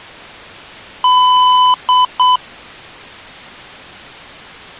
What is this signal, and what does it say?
Beep code, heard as beeps from a small speaker, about 1000 Hz. 1 long, 2 short. In Award, IBM and AMI BIOS tables: video adapter failure.